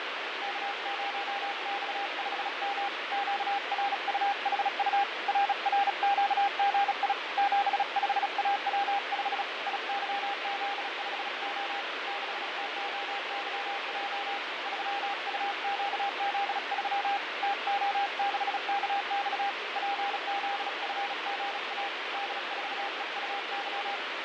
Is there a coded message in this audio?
Yes: Morse code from 0.4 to 24.0 s, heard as a keyed tone, hand-sent with a bug key, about 36 wpm, 800 Hz, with heavy radio static and fading. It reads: K0X5M QRUHU RRQGI 75AW5 IYZ5O 6TOYJ 3UQZ3 TO6KX PZFGA D4EUY